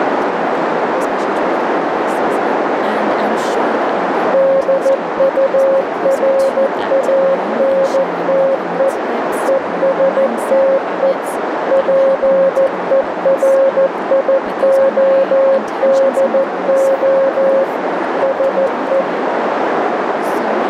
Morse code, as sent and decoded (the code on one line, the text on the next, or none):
-.. ..- .-. .- -. - . / . ... - . / .--. . .-. .. --- -.. --- / ... .
DURANTE ESTE PERIODO SE